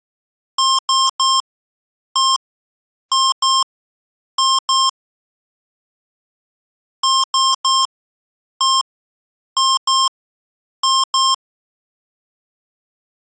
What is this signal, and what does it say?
Beep code, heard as beeps from a small speaker, played twice, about 1060 Hz. 3-1-2-2.